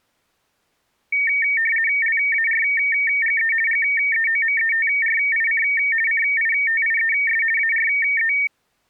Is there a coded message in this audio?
Yes: RTTY (50 baud, 450 Hz shift) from 1.1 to 8.5 s, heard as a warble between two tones, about 2050 Hz centre. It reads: LARGE GEOMETRIC CITIES ARE